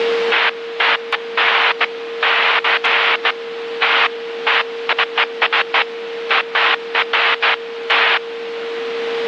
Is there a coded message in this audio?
No, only bursts of noise, with radio static and a steady whistle near 460 Hz.